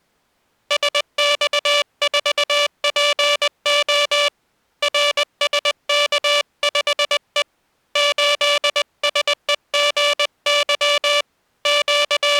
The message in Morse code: SX4PO RSK5E 8SEGY …

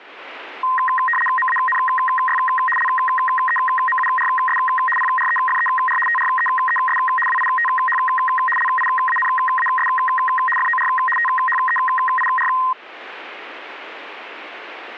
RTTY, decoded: MANY LEMURS PREFER TREES WITH LIANAS FOR THEIR

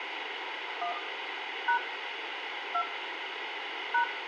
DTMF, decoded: 1 # 2 #

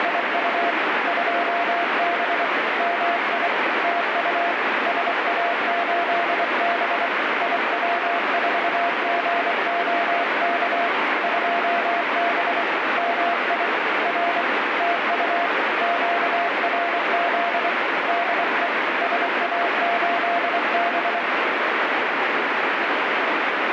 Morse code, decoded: … 2B MI TU SA8B IW4GOK 2B MI R TU QRZ DE SA8B

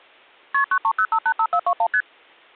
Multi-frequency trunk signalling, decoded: KP 930585421 ST

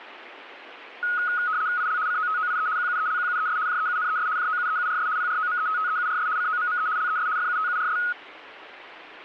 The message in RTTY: IL COTOIE QUELQUES JEUNES JOUEURS PROMETTEURS COMME LES FUTURS

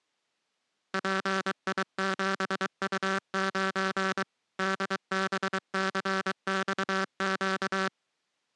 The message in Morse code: PI7U9 DBCXQ

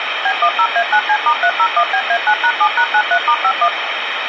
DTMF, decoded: B10A9C*301BA9#7#93*51

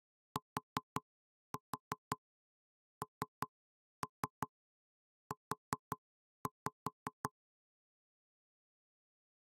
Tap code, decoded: TNU

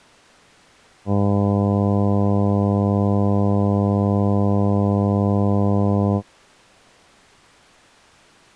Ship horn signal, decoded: 1 long

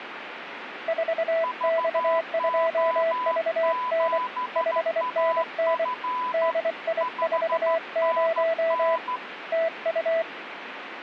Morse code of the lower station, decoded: 4X2VN 5NN DI40 TU

